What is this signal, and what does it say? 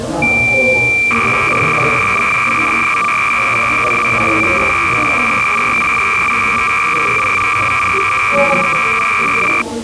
Cassette data (Kansas City type), 300 baud, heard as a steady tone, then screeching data, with the noise of a crowd indoors.